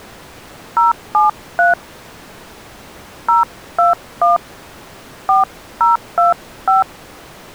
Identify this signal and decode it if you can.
DTMF, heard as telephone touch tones, dialled by hand, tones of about 150 ms. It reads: 073 021 4025